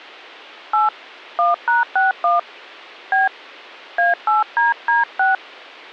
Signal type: DTMF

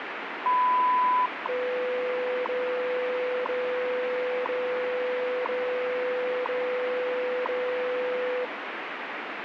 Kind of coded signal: radio time signal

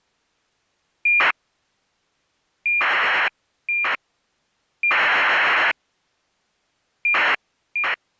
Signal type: ACARS aircraft data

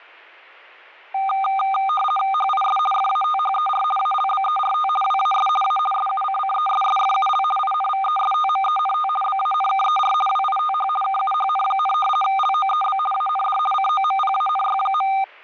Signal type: RTTY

